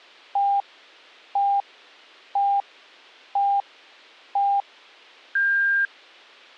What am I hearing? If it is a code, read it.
Radio time signal (five pips and a higher one, as on Chinese radio), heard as pips.